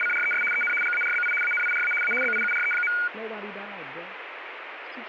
RTTY (75 baud, 850 Hz shift), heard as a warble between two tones, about 1850 Hz centre, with radio static. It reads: … EN GARBI ANIRA A BIURE.